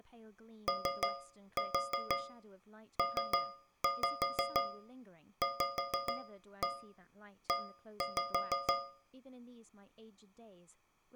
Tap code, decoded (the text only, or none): OPVE